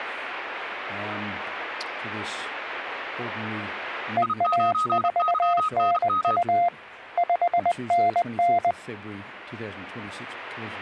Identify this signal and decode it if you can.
Morse code, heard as two keyed tones. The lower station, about 20 wpm, 700 Hz: EA4NU 5NN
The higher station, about 32 wpm, 1260 Hz: I9YNM